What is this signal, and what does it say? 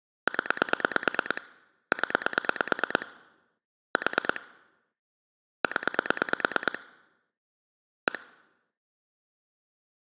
Pulse dialling, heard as clicks on a phone line, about 9 pulses a second. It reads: 0 0 4 0 1